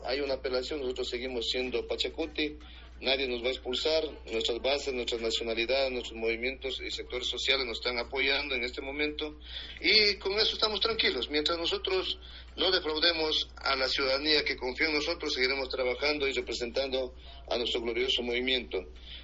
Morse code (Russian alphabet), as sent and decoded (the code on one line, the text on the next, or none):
none